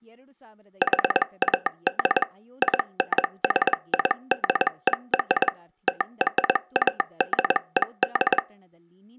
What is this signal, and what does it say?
Morse code (American railroad code), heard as a telegraph sounder, machine-sent, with speech in Kannada. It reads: HAD INSIDER TRADED